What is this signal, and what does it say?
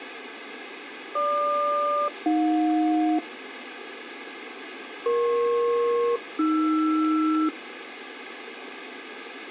Aircraft SELCAL, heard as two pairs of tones, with radio static. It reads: GQ-AJ EP-AR